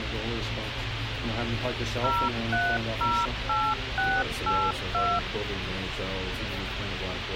DTMF, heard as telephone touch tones, dialled by machine, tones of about 250 ms, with radio hiss. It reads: 0308682